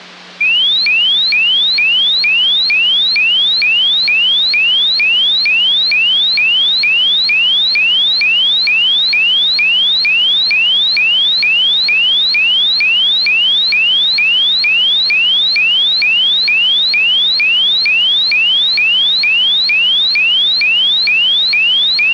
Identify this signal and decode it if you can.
A tone that sweeps in pitch again and again. There is no code.